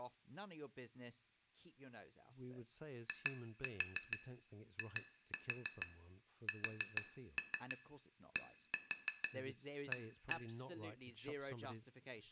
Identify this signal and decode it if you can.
Tap code, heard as taps on glass, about 6 knocks a second, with room echo and speech in English. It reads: IISDA